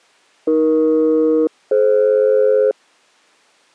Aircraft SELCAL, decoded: AE-DF

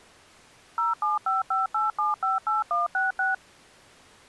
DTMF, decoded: 07558758166

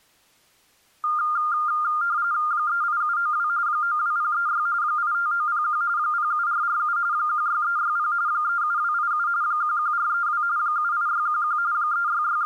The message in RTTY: 38792 92036 85901 07447 16360 37287 11432 78611 …

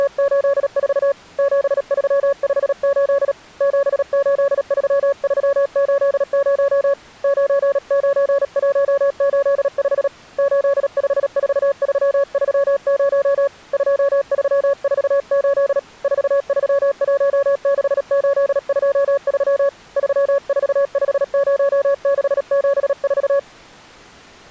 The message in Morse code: … 7358 783380 99185 854330 2348 4316823 3450674

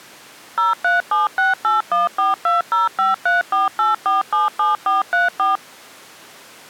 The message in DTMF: 0376814205348477434

